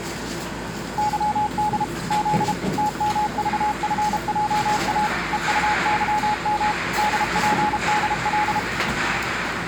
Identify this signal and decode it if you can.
Morse code, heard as a keyed tone, machine-sent, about 32 wpm, 840 Hz, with the noise of a cafe. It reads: YD Z TMVFJA EUYM DPDL